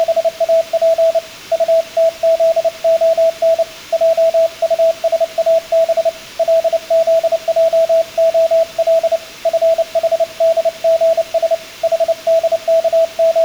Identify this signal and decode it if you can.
Morse code, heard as a keyed tone, hand-sent with a paddle, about 29 wpm, 660 Hz, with room echo. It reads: … UTZON JUSAB LZJOL FHDGS …